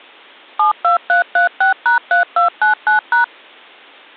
DTMF, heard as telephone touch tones, dialled by machine, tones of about 120 ms. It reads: 72336#3299#